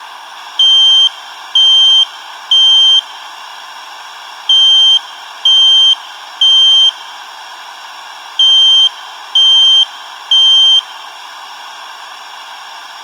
Alarm pattern, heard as an alarm's beeps, played three times, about 3150 Hz. Temporal three. Smoke or fire, evacuate.